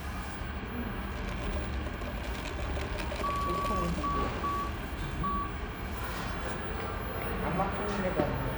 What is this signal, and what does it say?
Morse code, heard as a keyed tone, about 6 wpm, 1140 Hz, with radio static, room echo and the noise of a cafe. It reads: DE